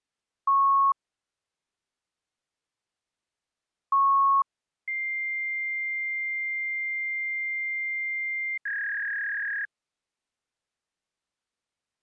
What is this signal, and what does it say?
Fax machine handshake, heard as beeps, a long tone and a warble.